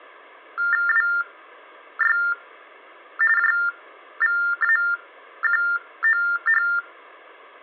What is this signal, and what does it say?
TTY/TDD text telephone tones (45.45 baud Baudot), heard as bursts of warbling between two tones, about 400 Hz shift, 1600 Hz centre. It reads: WY JVAQOH